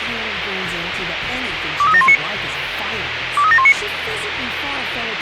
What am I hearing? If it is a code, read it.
Five-tone selective call (ZVEI), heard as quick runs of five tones, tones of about 70 ms, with radio hiss. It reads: 23719 23719